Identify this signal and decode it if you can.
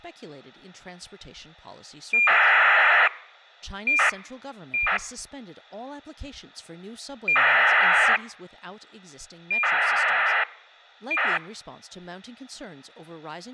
ACARS aircraft data, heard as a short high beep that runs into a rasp, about 2400 baud, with speech in English.